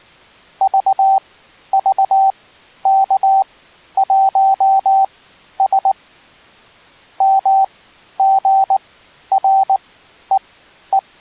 Morse code, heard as a keyed tone, machine-sent, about 19 wpm, spaced as for 11 wpm, 780 Hz. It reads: VVK1S MGREE